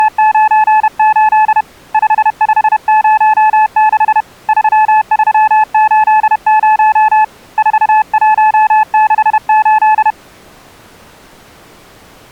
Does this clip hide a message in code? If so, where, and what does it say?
Yes: Morse code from 0.0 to 10.2 s, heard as a keyed tone, hand-sent with a paddle, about 31 wpm, 860 Hz. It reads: … 5506 3380 4168